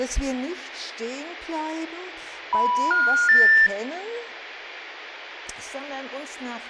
Telephone call progress tone (North American plan), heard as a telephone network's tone, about 980, 1430, 1800 Hz, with hum and room echo. Special information tone.